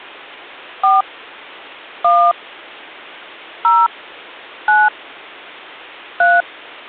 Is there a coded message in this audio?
Yes: DTMF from 0.8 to 6.4 s, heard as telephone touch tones, dialled by hand, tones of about 200 ms. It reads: 4 1 0 9 3